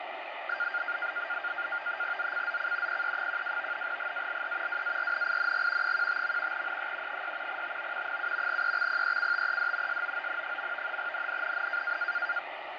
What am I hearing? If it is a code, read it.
NAVTEX (SITOR-B), 100 baud, 170 Hz shift, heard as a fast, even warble, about 1500 Hz centre, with radio static and fading. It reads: ZCZC PE12 GALE WARNING 15. NE 6 TO 7 EXPECTED SOON. NNNN